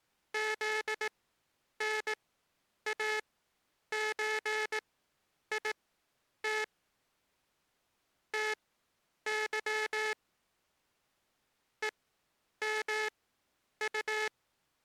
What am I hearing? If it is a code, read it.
Morse code (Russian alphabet), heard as a buzzer, machine-sent, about 18 wpm, spaced as for 9 wpm. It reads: ЗНАЧИТ ТЫ ЕМУ